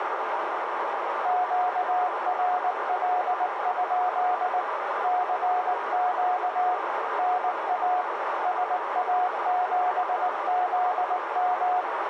Morse code, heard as a keyed tone, machine-sent, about 19 wpm, 730 Hz, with radio static and a narrow filter. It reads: QRL? CQ NA SA7ZM